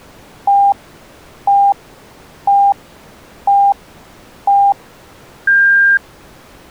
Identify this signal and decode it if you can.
Radio time signal (five pips and a higher one, as on Chinese radio), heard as pips.